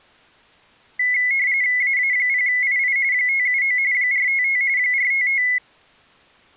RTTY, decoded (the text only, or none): AA0II 579 455 455